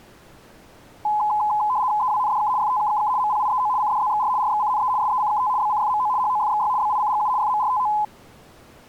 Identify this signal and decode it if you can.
RTTY (75 baud, 170 Hz shift), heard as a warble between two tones, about 930 Hz centre. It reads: EWNDK FTKKK MPIEO CDZXR RXCNE SECKT BCFMO HOFXY BICGU FMRTO